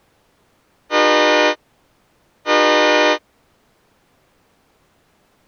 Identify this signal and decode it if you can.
Train horn signal, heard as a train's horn. 2 short. On North American railways: a signal is acknowledged.